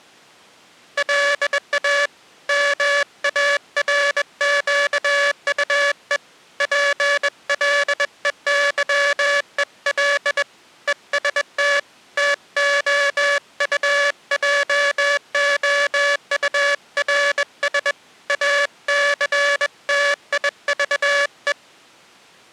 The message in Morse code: LA MARQUE PLEYEL EST TOUJOURS ACTIVE

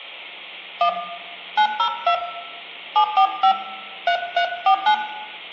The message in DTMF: 1 902 745 3349

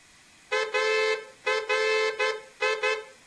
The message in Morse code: ARI

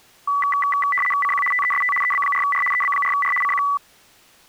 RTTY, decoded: CQ TEST EB4R EB4R CQ

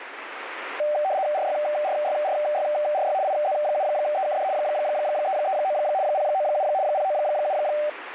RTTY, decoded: RYRYRYRY IZ7EKD 339 097 097

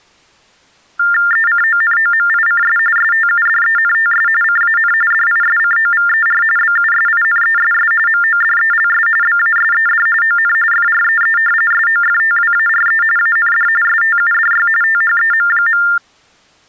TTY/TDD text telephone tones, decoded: ECONOMICS STUDENTS CAN DISCOVER BUSINESS MODELS BASED ON FREE SOFTWARE AND STUDY THEM.

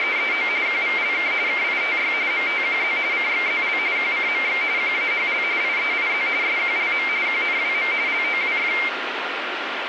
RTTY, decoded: … QVLK KITY MTQZ CXZL QCMX QAHL IEIZ SQLM QNWM LOWF

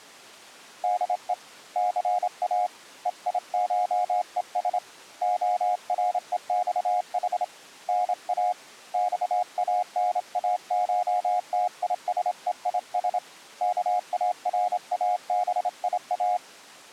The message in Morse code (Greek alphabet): ΔΕ ΘΑ ΕΙΧΕΣ ΟΡΕΞΗ ΝΑ ΞΑΝΑΧΤΙΣΕΙΣ ΚΑΡΑΒΙΑ

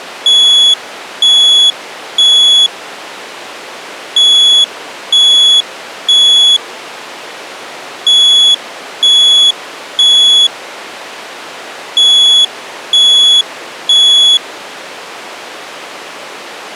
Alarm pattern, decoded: temporal three

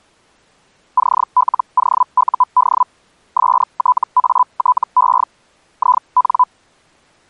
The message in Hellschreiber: CLOUD STATE IN

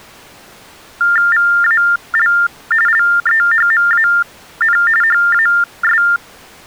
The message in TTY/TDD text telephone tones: VAL LEHMAN HAS

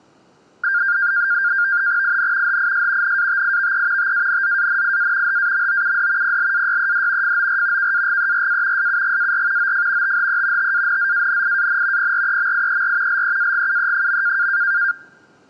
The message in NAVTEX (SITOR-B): IN HIS NATIVE TANZANIA HAMOUD PLAYED FOR KAGERA SUGAR OF THE TANZANIAN PREMIER LEAGUE.

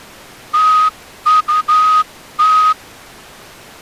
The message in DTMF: none

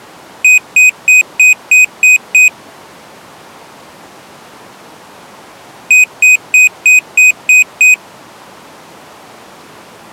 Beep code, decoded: 7 short

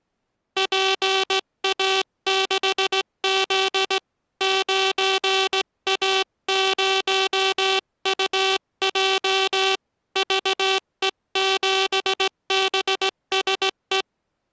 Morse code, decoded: PA6Z 9A0UJ VE7BSE

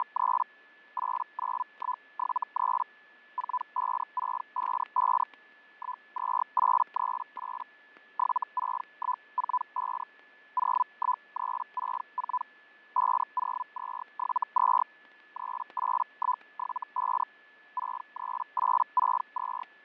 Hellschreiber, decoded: … 89173 45655 12838 76145 01364 50272 38175 63862

